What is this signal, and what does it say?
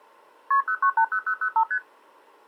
Multi-frequency trunk signalling (R1, as on North American trunks), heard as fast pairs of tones, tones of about 80 ms. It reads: KP 0980005 ST